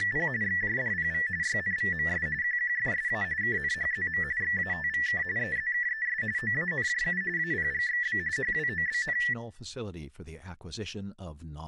RTTY (45.45 baud, 170 Hz shift), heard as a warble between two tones, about 1850 Hz centre, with room echo and speech in English. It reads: … XJDPV YNVMS QQFSA KNHZM XATVK EZKES OANJU APGXB HWOBN